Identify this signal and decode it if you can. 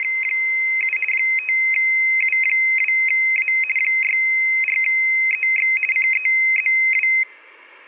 RTTY (50 baud, 450 Hz shift), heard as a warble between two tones, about 2300 Hz centre, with room echo. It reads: … 5U2A 64EX CEZW